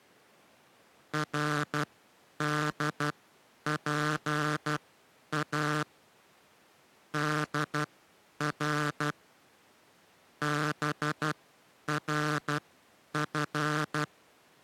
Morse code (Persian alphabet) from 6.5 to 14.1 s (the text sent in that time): در برف